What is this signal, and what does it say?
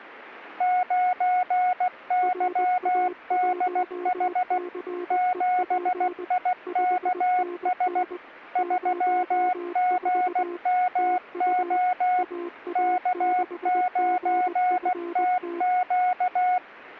Morse code, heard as two keyed tones. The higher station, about 16 wpm, 730 Hz: 9YDH 7IKS 3GMO K9TQ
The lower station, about 20 wpm, 350 Hz: RA1CEP 5NN 04 TU AA6GFT